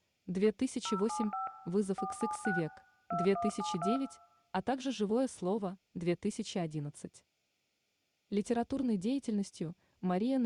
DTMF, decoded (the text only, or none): 075 476 2172